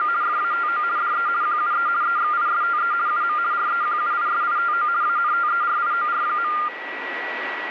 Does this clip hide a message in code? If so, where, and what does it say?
Yes: RTTY (50 baud, 170 Hz shift) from 0.0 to 6.7 s, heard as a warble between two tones, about 1300 Hz centre, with radio static and a steady whistle near 1940 Hz. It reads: … FATO DE QUE EXISTE UM REQUISITO ANTERIOR.